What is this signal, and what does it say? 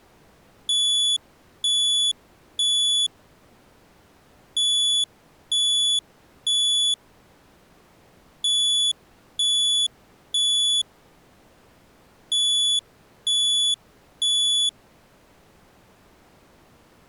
Alarm pattern, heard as an alarm's beeps, played four times, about 3450 Hz. Temporal three. Smoke or fire, evacuate.